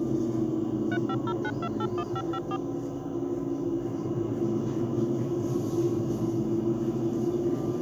DTMF, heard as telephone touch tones, dialled by machine, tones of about 60 ms, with the noise inside a bus. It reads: 3509281554